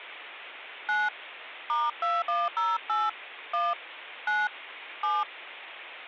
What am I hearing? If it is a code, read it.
DTMF, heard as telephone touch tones, dialled by hand, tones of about 200 ms. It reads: 9 *2108 1 9 7